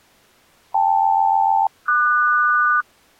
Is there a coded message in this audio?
Yes: aircraft SELCAL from 0.7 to 2.8 s, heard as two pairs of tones. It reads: KL-QS